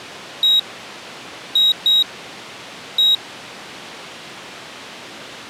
Beep code, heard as a piezo beeper, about 3800 Hz. 1-2-1. In Phoenix BIOS tables: interval timer failure.